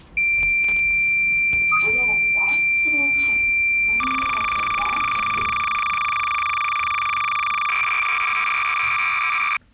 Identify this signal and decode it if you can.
Cassette data (Kansas City type), 300 baud, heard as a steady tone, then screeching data, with the noise inside a lift.